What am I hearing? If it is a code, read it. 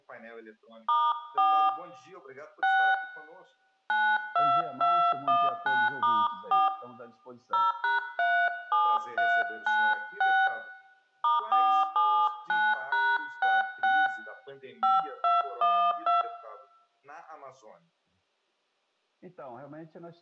DTMF, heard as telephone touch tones, dialled by hand, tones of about 230 ms, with room echo. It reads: *4 6 92219*4 0#37396 *479#66 5212